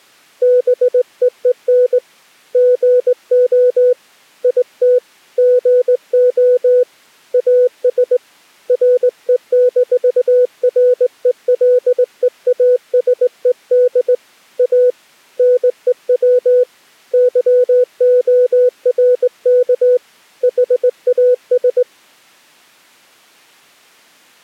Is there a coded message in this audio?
Yes: Morse code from 0.4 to 21.9 s, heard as a keyed tone, hand-sent with a straight key, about 19 wpm, 500 Hz. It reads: BEEN GO IT GO AS RE-RELEASED A NEW YORK HAS